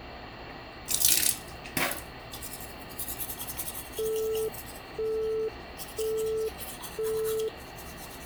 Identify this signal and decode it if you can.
Telephone call progress tone (single-tone plan, as in Europe, Japan and elsewhere), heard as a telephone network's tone, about 440 Hz, 0.5 s on and 0.5 s off, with phone line noise and the noise of a restroom. Busy tone.